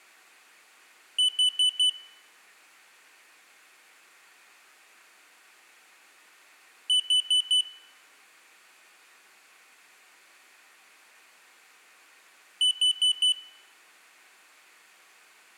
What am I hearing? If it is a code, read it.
Alarm pattern, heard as an alarm's beeps, played three times, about 3000 Hz, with room echo. Temporal four. Carbon monoxide.